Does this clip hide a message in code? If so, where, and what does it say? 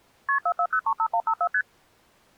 Yes: multi-frequency trunk signalling (R1, as on North American trunks) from 0.3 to 1.6 s, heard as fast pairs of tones, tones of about 70 ms. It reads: KP 44035154 ST